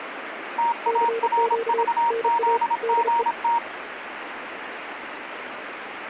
Morse code, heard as two keyed tones, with radio static. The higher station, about 26 wpm, 940 Hz: TARVZGT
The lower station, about 33 wpm, 460 Hz: CQ NA DE